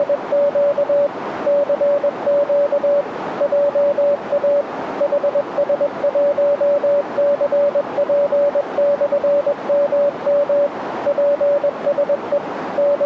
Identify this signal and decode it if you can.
Morse code, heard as a keyed tone, machine-sent, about 21 wpm, 570 Hz, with radio static and a narrow filter. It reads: … CQ JA HS1CP/MM PSE …